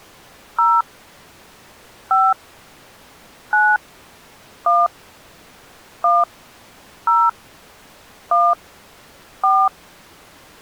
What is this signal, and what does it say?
DTMF, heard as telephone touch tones, dialled by hand, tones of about 210 ms. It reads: 0 5 9 1 1 0 1 4